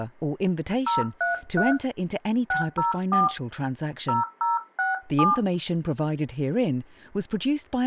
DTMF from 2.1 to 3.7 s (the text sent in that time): 604